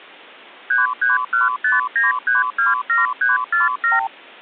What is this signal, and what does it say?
Multi-frequency trunk signalling (R2, with the far end's replies), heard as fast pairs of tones, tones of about 160 ms. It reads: 33159327347